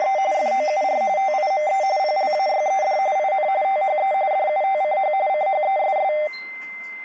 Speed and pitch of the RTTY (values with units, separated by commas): 45.45 baud, 170 Hz shift, 690 Hz centre